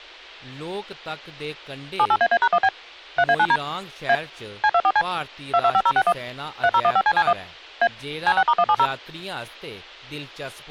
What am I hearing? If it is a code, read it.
DTMF, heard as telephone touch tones, dialled by machine, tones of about 60 ms, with speech in Dogri. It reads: 78AA#1B 3A9D A C24C 225061 3015CC1 A C6*170